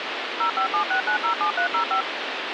DTMF, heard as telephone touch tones, dialled by machine, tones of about 100 ms, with phone line noise. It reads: 0576907305